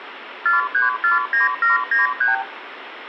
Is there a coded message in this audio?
Yes: multi-frequency trunk signalling (R2, with the far end's replies) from 0.5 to 2.4 s, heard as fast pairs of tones, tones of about 150 ms, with phone line noise and room echo. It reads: 4349793